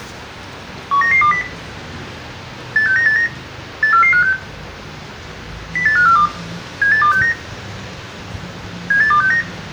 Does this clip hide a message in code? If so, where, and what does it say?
Yes: five-tone selective call (CCIR) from 0.9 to 9.4 s, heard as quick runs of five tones, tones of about 100 ms, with room echo and the noise of a residential street. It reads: 19920 86989 84456 08542 78269 78269